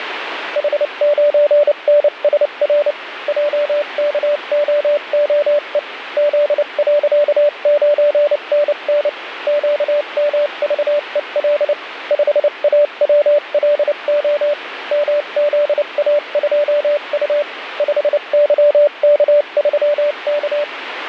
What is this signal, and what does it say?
Morse code, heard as a keyed tone, machine-sent, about 29 wpm, spaced as for 26 wpm, 590 Hz, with radio static. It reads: H9NSR JKOOE Z.9NN QMVEL 5AWLO MZA2U 5YK3K